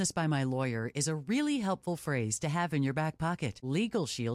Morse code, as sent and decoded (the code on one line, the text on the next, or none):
none